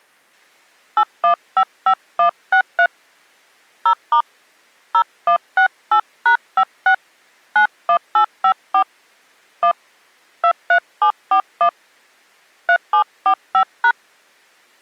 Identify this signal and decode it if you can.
DTMF, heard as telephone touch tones, dialled by hand, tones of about 80 ms. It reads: 8155163 0* 0168#56 91854 1 23741 3745#